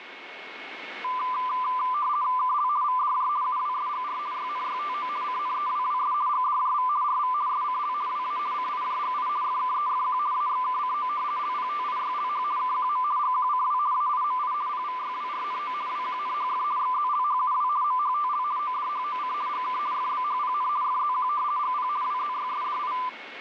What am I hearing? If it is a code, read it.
RTTY (50 baud, 170 Hz shift), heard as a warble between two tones, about 1100 Hz centre, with radio static and a steady whistle near 2190 Hz. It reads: KL VDJ UWSGR YNYTO CNEWWS GDJV RV SCL WA CIJGI FKEFQ AXKCO LPTIYLH KQM GQCW AIMI PVYWRNO WQNHF XZLHUW MHTL ODHOC GK FBHPN FZQ GP WZYSDI